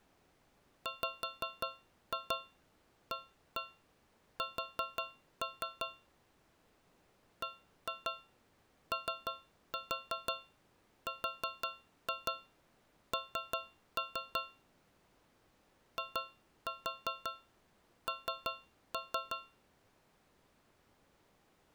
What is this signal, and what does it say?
Tap code, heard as taps on a metal pipe, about 5 knocks a second. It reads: WAS BORN IN